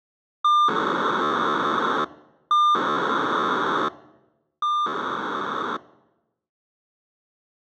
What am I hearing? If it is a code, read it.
POCSAG pager data (2400 baud), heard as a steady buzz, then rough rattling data.